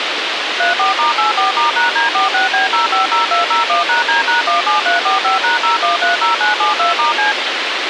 DTMF, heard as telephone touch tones, dialled by machine, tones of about 140 ms, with radio hiss. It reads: 34*84*#D46B050201#D#17345#0130972*C